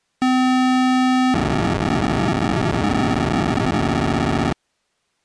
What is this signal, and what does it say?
POCSAG pager data (512 baud), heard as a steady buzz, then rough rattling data.